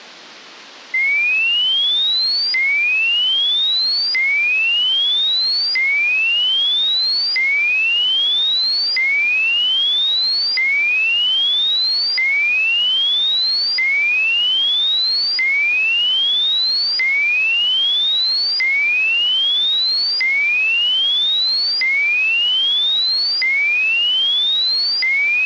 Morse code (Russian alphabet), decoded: none

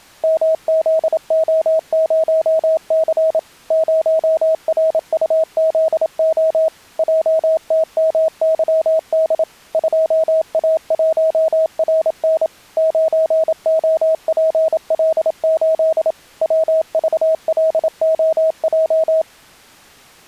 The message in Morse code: MZO0C 0RUZO JTMYD 2A1RN 9OPL8 WVLOJ

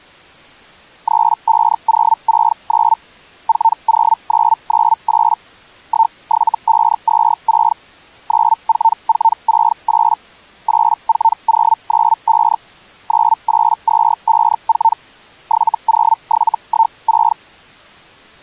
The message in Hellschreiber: 35069 40998 17526 94468 84095 98254 70716

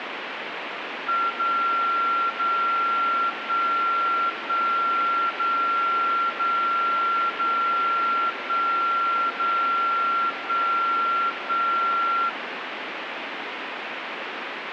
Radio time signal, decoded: 0 0 1 1 0 0 0 1 0 1 1

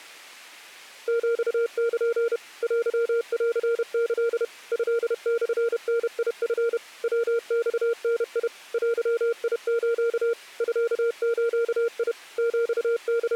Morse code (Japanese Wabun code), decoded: ヒル テンキ トモダチ ヤマダ デス ミズ …

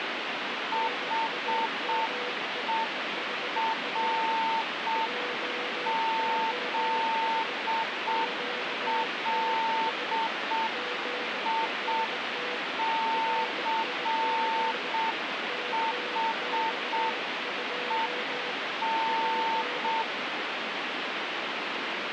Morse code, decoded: HERZLICHEN

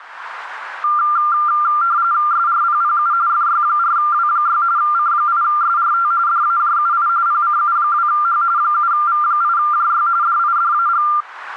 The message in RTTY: SRPPU FY4W6 C8SRT DAJUI PCU2H 7V8JY DIDAG

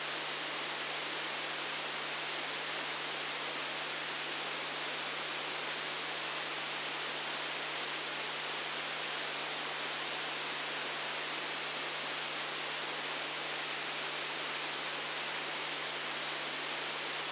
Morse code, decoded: none

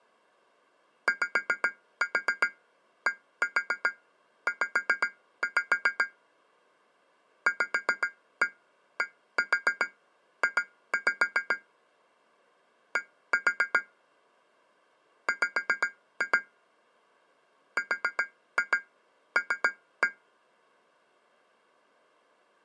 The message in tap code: YDZ VDJ D W RL

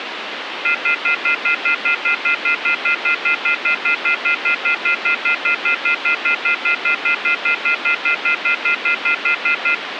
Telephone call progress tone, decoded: off-hook warning tone

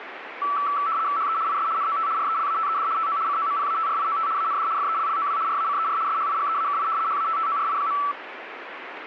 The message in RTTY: HE IS NOT RELATED TO COMPATRIOT AND FELLOW RACER SHIGEAKI HATTORI.

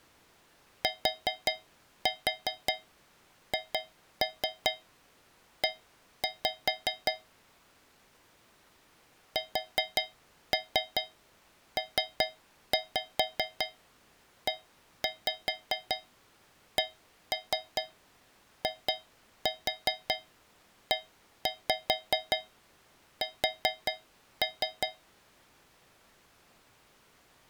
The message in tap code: THE SPECIES

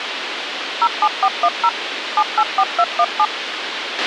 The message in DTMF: 07410 784217

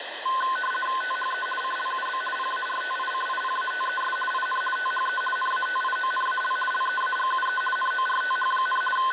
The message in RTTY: THE CLUB PARTICIPATES IN THE NATIONAL LEAGUE NORTH, …

